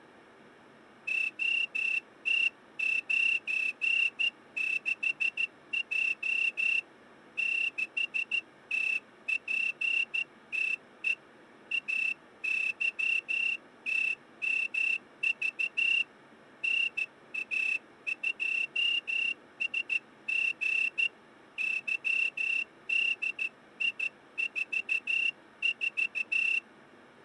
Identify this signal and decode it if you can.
Morse code, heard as a whistle, hand-sent with a straight key, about 14 wpm. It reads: OT96J 6TPTE AYTMV NA2SG YDI44